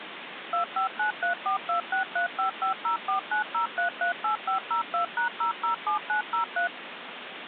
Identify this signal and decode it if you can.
DTMF, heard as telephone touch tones, dialled by machine, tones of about 110 ms, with phone line noise. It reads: 25934263550490338502#007903